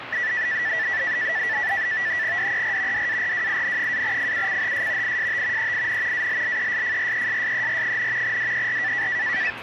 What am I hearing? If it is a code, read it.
NAVTEX (SITOR-B), 100 baud, 170 Hz shift, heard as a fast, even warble, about 1850 Hz centre, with radio static and the noise of a residential street. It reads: DER DARWIN-FUCHS IST EIN ALLESFRESSER, DER